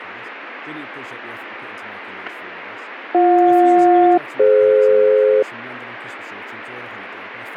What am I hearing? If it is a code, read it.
Aircraft SELCAL, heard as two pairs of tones, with radio static and speech in English. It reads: BJ-DF